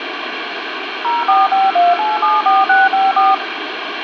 DTMF, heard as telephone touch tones, dialled by machine, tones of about 190 ms, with phone line noise and room echo. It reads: 0452874654